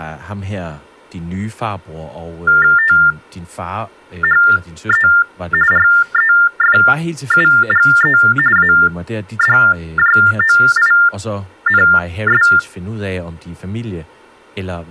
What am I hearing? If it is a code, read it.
TTY/TDD text telephone tones (45.45 baud Baudot), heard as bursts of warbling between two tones, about 400 Hz shift, 1600 Hz centre, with speech in Danish. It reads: THE REFUGE ADJOINS